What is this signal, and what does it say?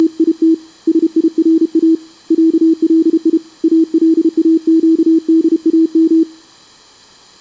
Morse code (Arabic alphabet), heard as a keyed tone, hand-sent with a paddle, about 32 wpm, 320 Hz. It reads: … سيرا علي الاقدام